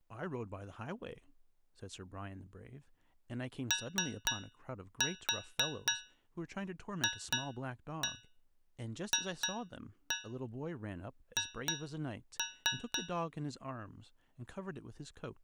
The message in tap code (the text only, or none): OFFH